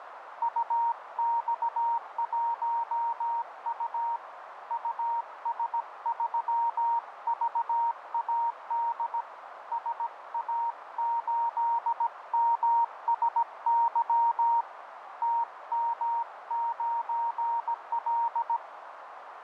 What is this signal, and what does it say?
Morse code, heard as a keyed tone, hand-sent with a paddle, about 17 wpm, 930 Hz, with radio static and a narrow filter. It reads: UX1U US3VAD SA8MSY TM9L